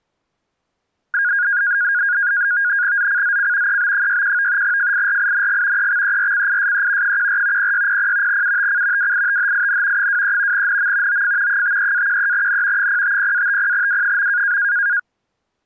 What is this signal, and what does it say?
NAVTEX (SITOR-B), 100 baud, 170 Hz shift, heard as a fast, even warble, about 1550 Hz centre. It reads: ZCZC EB61 FIRING EXERCISE 14 0600 UTC WITHIN 23 NM OF 53-13N 050-50W.